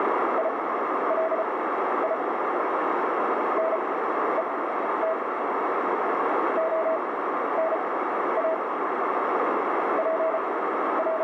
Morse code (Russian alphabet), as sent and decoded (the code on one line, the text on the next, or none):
.. .-.. .. / -. . - / --- -. .- / …
ИЛИ НЕТ ОНА …